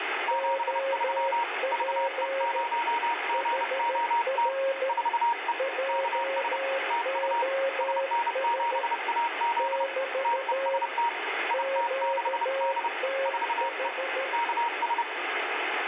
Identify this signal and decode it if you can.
Morse code, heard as two keyed tones, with radio static. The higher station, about 30 wpm, 940 Hz: 73 VE0GOT 4E KS TU SN7AZ TEST IT6D 4E KS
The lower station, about 13 wpm, 540 Hz: OP HR JOS <BT> QTH